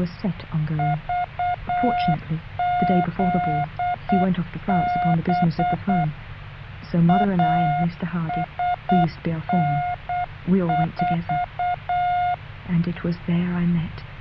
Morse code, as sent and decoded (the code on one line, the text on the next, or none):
...- --.. -... / .- ... -. ....-
VZB ASN4